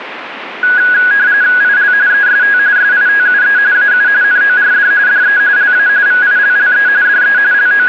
RTTY (45.45 baud, 170 Hz shift), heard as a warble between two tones, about 1550 Hz centre, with radio static. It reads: IL EST SITUE AU NORD DE LA VILLE DE …